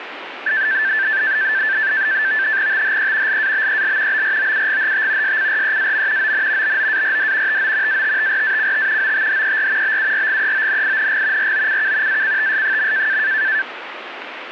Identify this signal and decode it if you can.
NAVTEX (SITOR-B), 100 baud, 170 Hz shift, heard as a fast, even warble, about 1650 Hz centre, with radio static. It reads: THE LABEL BROUGHT SCREAM ON BOARD TO ATTRACT OTHER BURGEONING ROCK ACTS.